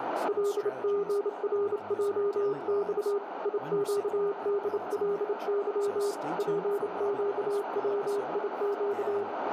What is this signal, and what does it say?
Morse code, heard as a keyed tone, hand-sent with a bug key, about 28 wpm, 410 Hz, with radio static, a narrow filter and speech in English. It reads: LGRJX IQDLY PQWIQ